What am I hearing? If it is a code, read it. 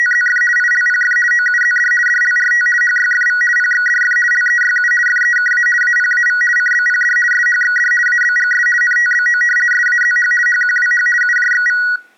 RTTY (50 baud, 450 Hz shift), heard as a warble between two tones, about 1700 Hz centre. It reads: … ILPF OUZD DLRT HYFV PXDF LEYU FEKA APAV CBPD SHXD ABGS NTBO SAZH HQWH UJXV